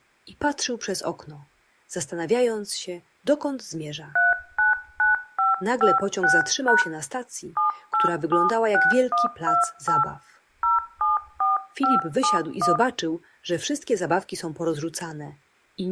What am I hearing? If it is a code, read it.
DTMF, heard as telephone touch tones, dialled by hand, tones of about 150 ms, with room echo. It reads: 399556# 7876128 074571